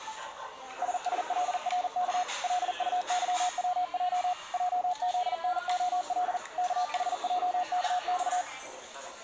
Morse code, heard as a keyed tone, machine-sent, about 40 wpm, 720 Hz, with the noise of a restaurant. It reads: SSLRK LUYWJ JZNOL KHJKX